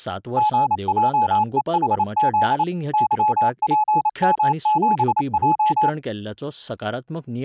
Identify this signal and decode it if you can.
Morse code, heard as a keyed tone, machine-sent, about 28 wpm, 850 Hz, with speech in Goan Konkani. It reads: GJEHZ YPM7J